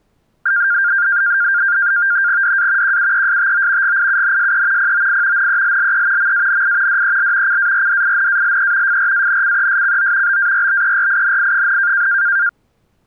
NAVTEX (SITOR-B), 100 baud, 170 Hz shift, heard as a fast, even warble, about 1500 Hz centre. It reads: DA QUESTO GIUNSE POI NELLE MANI DEL CARDINALE FRANCESCO BARBERINI,